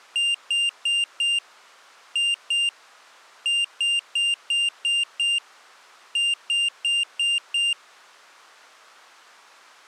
Beep code, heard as a piezo beeper, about 2800 Hz. 4-2-6-5.